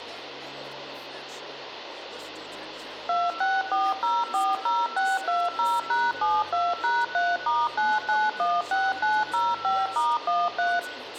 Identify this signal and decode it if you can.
DTMF, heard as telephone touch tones, dialled by machine, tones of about 210 ms, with phone line noise and room echo. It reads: 264040620#72#3*9916905*13